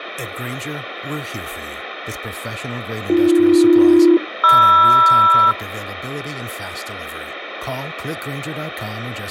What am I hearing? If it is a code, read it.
Aircraft SELCAL, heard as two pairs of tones, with radio static and speech in English. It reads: AB-MR